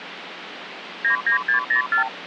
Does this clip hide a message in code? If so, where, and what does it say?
Yes: multi-frequency trunk signalling (R2, with the far end's replies) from 1.0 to 2.1 s, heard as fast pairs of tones, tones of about 110 ms, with phone line noise. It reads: 99604